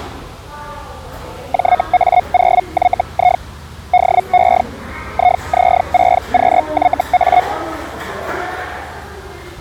Hellschreiber (Feld-Hell, 122.5 baud), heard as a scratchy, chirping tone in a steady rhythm, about 720 Hz, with the noise of a restaurant. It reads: JA0YI DE IZ6QYA